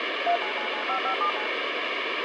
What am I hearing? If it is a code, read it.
DTMF, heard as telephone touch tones, dialled by machine, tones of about 90 ms, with radio hiss. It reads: 39995579